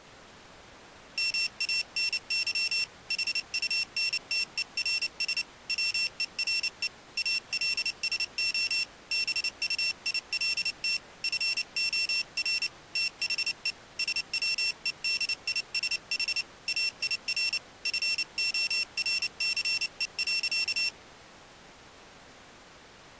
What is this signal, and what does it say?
Morse code, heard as a high beeper, hand-sent with a paddle, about 29 wpm, 2700 Hz. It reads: MANY HUNTERS WERE ALSO BUILT FOR THE SWEDISH AIR FORCE.